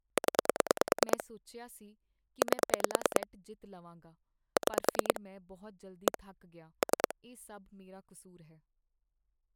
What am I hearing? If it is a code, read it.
Pulse dialling, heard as clicks on a phone line, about 9 pulses a second, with speech in Punjabi. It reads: 0 8 6 1 3